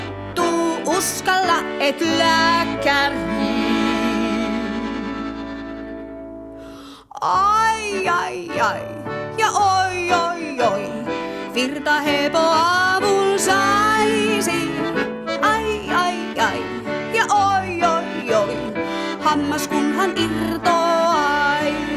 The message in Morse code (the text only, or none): none